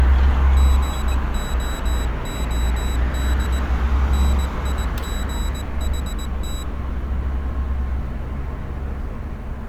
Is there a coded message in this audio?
Yes: Morse code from 0.5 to 6.7 s, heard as a high beeper, hand-sent with a paddle, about 19 wpm, 3900 Hz, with street noise. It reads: GOOD NIGHT